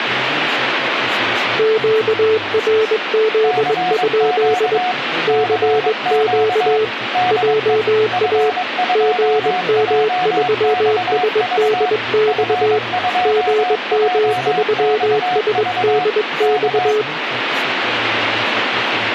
Morse code, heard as two keyed tones, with radio static and speech in Turkish. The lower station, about 21 wpm, 430 Hz: QRZ? CQ JA GM3SDX GM3SDX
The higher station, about 22 wpm, 730 Hz: CQ CQ DE F2JXV F2JXV K